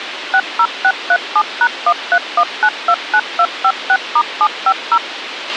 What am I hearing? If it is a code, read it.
DTMF, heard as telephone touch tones, dialled by machine, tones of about 60 ms, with radio hiss and a squelch burst at the end. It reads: 60637#131929256*750